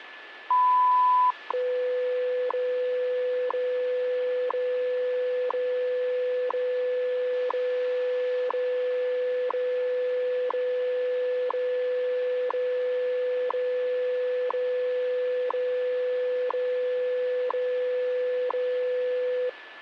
Radio time signal (WWV, Colorado), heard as ticks, one a second, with radio static and a steady whistle near 1730 Hz.